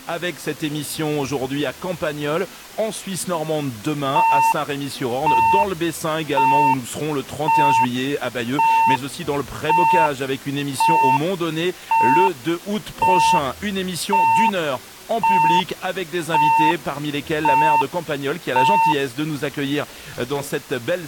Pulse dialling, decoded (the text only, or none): none